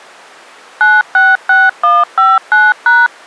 DTMF, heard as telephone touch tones, dialled by machine, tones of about 200 ms. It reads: 966159#